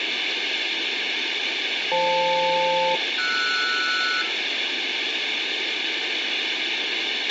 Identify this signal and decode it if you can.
Aircraft SELCAL, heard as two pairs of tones, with radio hiss, a squelch burst at the end and room echo. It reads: FL-RS